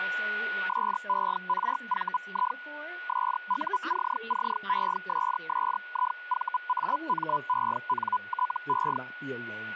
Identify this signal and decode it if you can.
Hellschreiber (Feld-Hell, 122.5 baud), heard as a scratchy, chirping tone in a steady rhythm, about 1000 Hz, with a steady whistle near 1460 Hz and speech in English. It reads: SERVI SUCCESSIVAMENTE